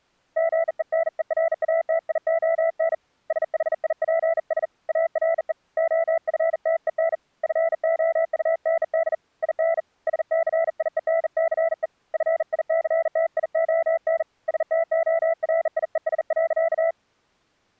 Morse code, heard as a keyed tone, hand-sent with a bug key, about 40 wpm, 660 Hz. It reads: GENERATION SHIPS ARE OFTEN FOUND IN SCIENCE FICTION STORIES.